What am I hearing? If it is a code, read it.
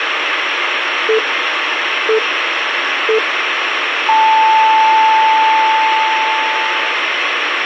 Radio time signal (three low pips and a long one an octave up, as on NHK), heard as pips, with radio hiss.